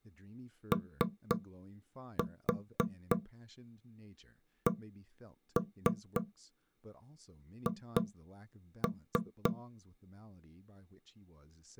Tap code, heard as knocks on wood, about 3 knocks a second, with speech in English. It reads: OCH